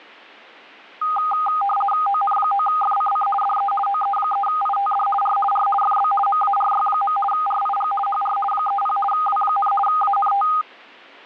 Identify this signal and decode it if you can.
RTTY (50 baud, 450 Hz shift), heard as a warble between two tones, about 1020 Hz centre. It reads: ON9FCC DE OE3ITD R R FB MARY. RIG HR 30 W, ANT